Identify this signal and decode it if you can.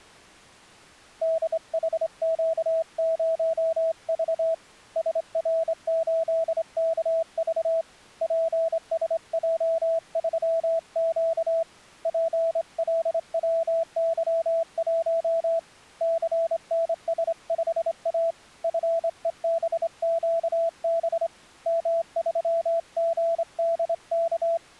Morse code, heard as a keyed tone, hand-sent with a straight key, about 26 wpm, 660 Hz. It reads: DHQ0V SR8KV PSJ3Q PLWY1 CNS5A FEBQB M3GDK